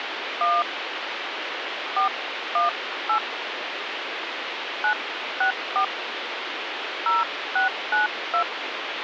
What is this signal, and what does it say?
DTMF, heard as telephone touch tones, dialled by hand, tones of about 160 ms, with phone line noise. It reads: 1 418 964 0692